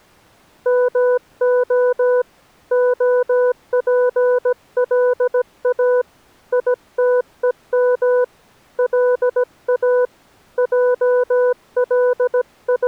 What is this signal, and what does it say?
Morse code (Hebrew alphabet), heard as a keyed tone, hand-sent with a paddle, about 17 wpm, 500 Hz. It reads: מה הפלא יתום לא …